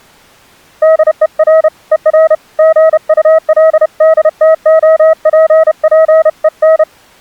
Morse code, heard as a keyed tone, hand-sent with a paddle, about 31 wpm, 640 Hz. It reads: DER ER GULDTOPPEN